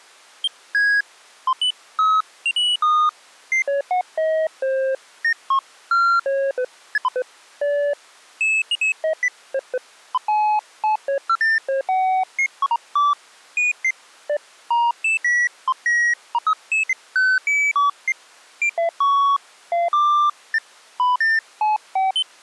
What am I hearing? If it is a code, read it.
Electronic bleeps of random pitch and length. There is no code.